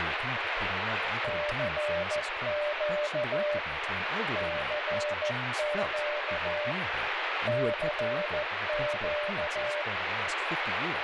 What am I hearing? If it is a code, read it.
Morse code, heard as a keyed tone, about 14 wpm, 590 Hz, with heavy radio static and speech in English. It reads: CQ CQ CQ